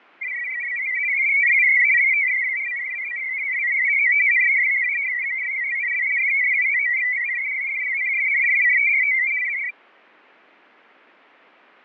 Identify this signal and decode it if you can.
Multi-tone FSK (Olivia or MFSK type), about 500 Hz wide, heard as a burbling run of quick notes, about 62.5 baud, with fading.